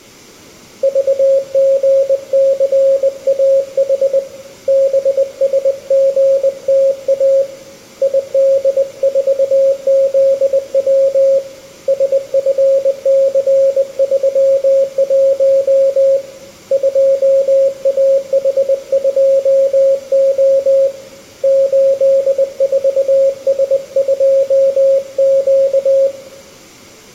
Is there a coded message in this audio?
Yes: Morse code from 0.8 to 26.1 s, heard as a keyed tone, hand-sent with a bug key, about 20 wpm, 540 Hz, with room echo. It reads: VGCAH BSGTA ID4ZW SFC31 2AH2O 84S2Q